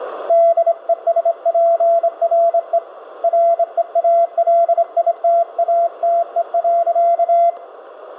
Morse code, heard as a keyed tone, hand-sent with a straight key, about 26 wpm, 680 Hz, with radio static and room echo. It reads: DESPRE REALITATE.